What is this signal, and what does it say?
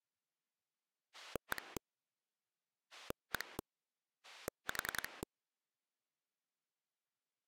Pulse dialling, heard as a rotary dial, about 10 pulses a second. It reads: 1 1 4